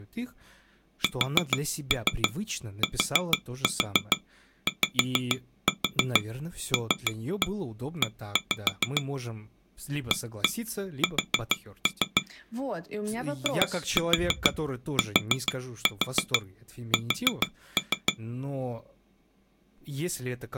Tap code, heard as taps on glass, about 6 knocks a second, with speech in Russian. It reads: STYLE AS ITS